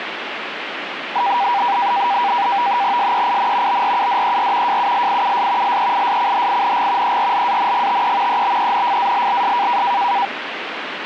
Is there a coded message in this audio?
Yes: NAVTEX (SITOR-B), 100 baud, 170 Hz shift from 1.2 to 10.3 s, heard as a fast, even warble, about 880 Hz centre, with radio static. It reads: SEIN BRUDER JULIUS LEISCHING ERLANGTE EBENFALLS